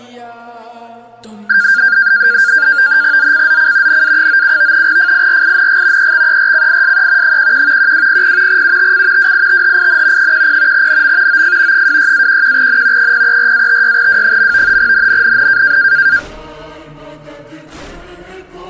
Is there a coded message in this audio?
Yes: NAVTEX (SITOR-B), 100 baud, 170 Hz shift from 1.5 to 16.2 s, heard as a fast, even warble, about 1500 Hz centre. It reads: ZCZC NA97 FIRING EXERCISE 11 1200 UTC WITHIN 10 NM OF 26-11N 034-56W. NNNN